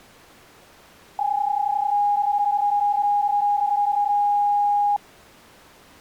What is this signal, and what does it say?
PSK31 (31.25 baud), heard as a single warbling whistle, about 820 Hz.